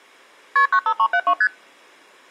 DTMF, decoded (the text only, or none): none